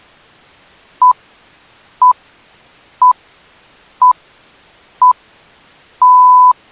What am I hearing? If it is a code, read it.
Radio time signal (six pips, as the Greenwich Time Signal), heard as pips.